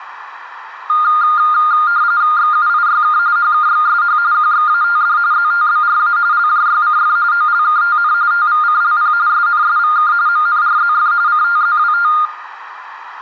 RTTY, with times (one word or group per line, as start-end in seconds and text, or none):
2.4-3.2 XUIYK
3.4-4.2 HKXSH
4.3-5.2 QXATD
5.3-6.2 ZTBRA
6.3-7.2 LJYCF
7.3-8.1 OLKTN
8.3-9.1 TVCLP
9.3-10.1 SNSVK
10.3-11.1 MNRZF
11.3-12.1 CTZWT